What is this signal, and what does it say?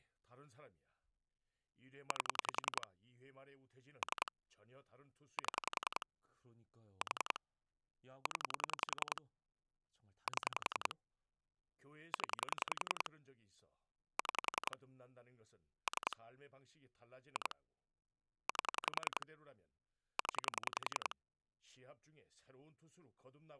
Pulse dialling, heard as clicks on a phone line, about 10 pulses a second, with speech in Korean. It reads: 8 3 7 4 0 7 0 6 3 2 8 0